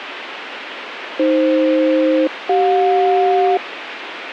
Aircraft SELCAL, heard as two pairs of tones, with radio hiss. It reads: AF-CJ